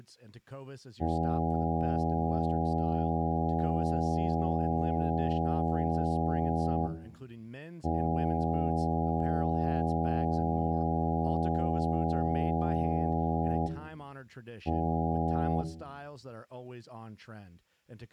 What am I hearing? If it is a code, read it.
Ship horn signal, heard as a ship's horn, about 80 Hz, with room echo and speech in English. 2 long, 1 short. At sea: I intend to overtake on your starboard side.